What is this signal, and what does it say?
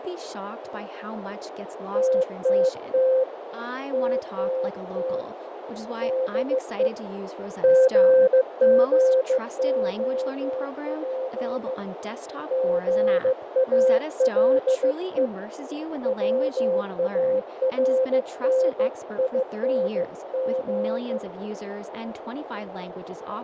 Morse code, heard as a keyed tone, hand-sent with a bug key, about 15 wpm, 520 Hz, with heavy radio static, fading, a narrow filter and speech in English. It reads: TTT TTT DE GGOP GALE WARNING